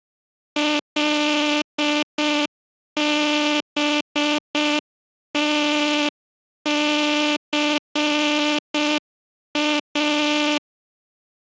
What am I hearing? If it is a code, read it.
Morse code, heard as a buzzer, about 6 wpm. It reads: LBTCA